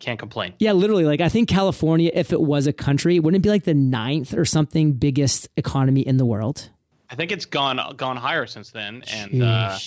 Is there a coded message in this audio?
No, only speech in English.